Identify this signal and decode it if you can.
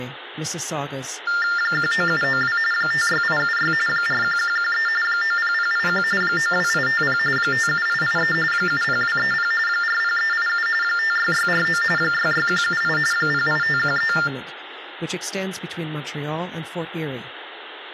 TTY/TDD text telephone tones (45.45 baud Baudot), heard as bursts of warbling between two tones, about 400 Hz shift, 1600 Hz centre, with phone line noise, room echo and speech in English. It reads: 19792 56876 41113 90081 92850 57883 70230 40387 56649 66178 08513